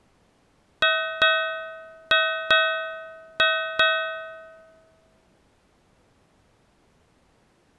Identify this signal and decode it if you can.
Ship's bell, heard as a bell. 6. Six half-hours of the watch have passed.